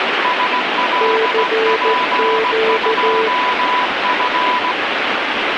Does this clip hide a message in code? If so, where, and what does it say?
Yes: Morse code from 0.2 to 4.8 s, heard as two keyed tones, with heavy radio static. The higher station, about 17 wpm, 990 Hz: SLP2F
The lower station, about 14 wpm, 440 Hz: CQ